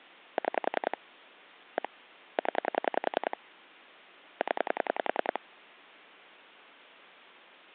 Pulse dialling, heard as clicks on a phone line, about 10 pulses a second. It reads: 6 1 0 0